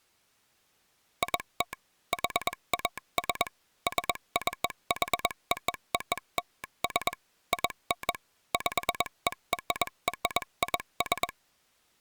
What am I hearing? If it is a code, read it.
Morse code (American railroad code), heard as a telegraph sounder, machine-sent. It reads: IT HAS SCHOOLS IN PERRIS